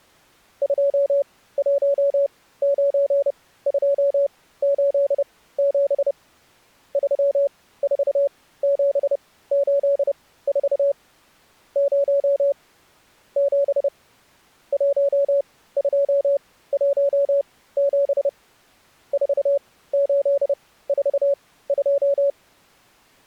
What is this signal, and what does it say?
Morse code, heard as a keyed tone, machine-sent, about 30 wpm, spaced as for 17 wpm, 560 Hz. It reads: 219287 34784 0 7 1217 4842